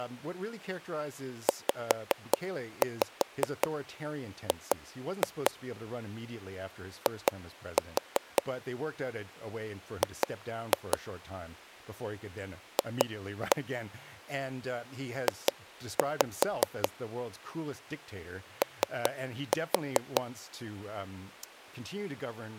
Tap code, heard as taps on a table, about 5 knocks a second, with speech in English. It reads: ZG I G F J O